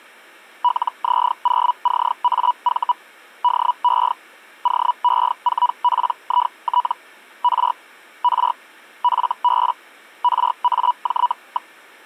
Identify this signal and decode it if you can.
Hellschreiber (Feld-Hell, 122.5 baud), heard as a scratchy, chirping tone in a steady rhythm, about 980 Hz. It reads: LZ0CAV DE OE4PIT R R FB RAJ.